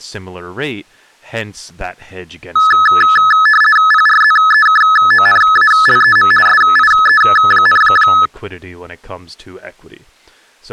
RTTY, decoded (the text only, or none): PRZEKONALEM SIE,